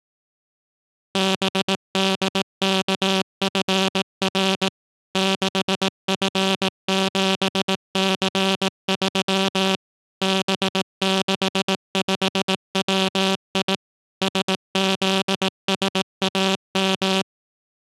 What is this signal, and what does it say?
Morse code, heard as a buzzer, machine-sent, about 18 wpm. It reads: BDKFR 6F7C3 B65WI SZSAM